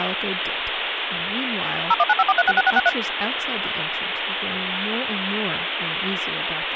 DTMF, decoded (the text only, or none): 01954366663